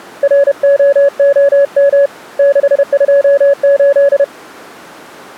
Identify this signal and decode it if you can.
Morse code, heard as a keyed tone, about 31 wpm, 560 Hz. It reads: ROOM 628